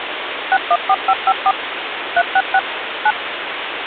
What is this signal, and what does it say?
DTMF, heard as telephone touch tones, dialled by machine, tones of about 50 ms, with phone line noise. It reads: 614554 366 9